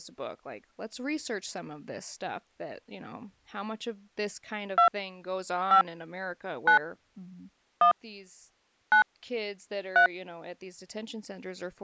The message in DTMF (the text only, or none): 2 5 9 1 9 3